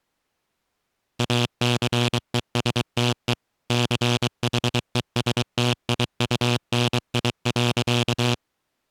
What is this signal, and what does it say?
Morse code, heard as a buzzer, machine-sent, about 23 wpm. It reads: ACESTE CHESTIUNI.